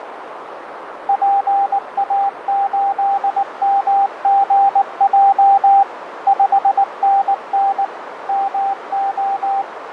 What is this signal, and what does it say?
Morse code, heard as a keyed tone, machine-sent, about 19 wpm, 790 Hz, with radio static, fading and a narrow filter. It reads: PA8MGJ 5NN MO